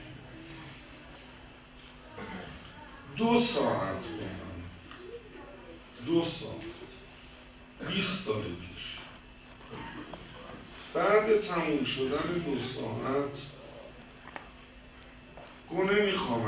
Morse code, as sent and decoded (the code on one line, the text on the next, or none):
none